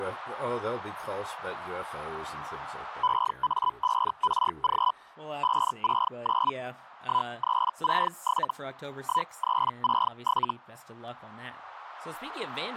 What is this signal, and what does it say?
Hellschreiber (Feld-Hell, 122.5 baud), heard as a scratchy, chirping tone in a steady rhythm, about 1000 Hz, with speech in English. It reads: EA5RG 569 1367 1367